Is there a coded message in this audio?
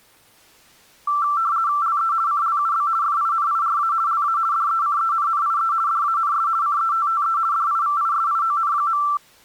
Yes: RTTY (50 baud, 170 Hz shift) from 1.1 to 9.2 s, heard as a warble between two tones, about 1250 Hz centre. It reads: LE CLUB FINIRA LA DECENNIE DANS CETTE DIVISION.